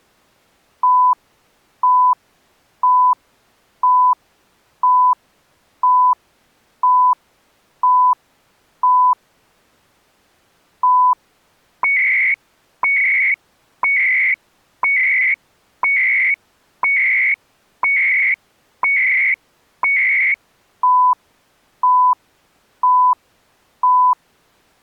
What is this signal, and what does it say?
Radio time signal (CHU, Canada), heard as beeps and data bursts, one a second.